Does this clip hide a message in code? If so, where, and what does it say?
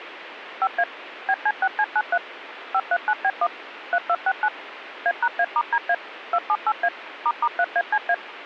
Yes: DTMF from 0.6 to 8.1 s, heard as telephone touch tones, dialled by machine, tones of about 60 ms, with radio hiss. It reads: 5A BC6C93 539B1 3269 A#A*DA 278A **3ACA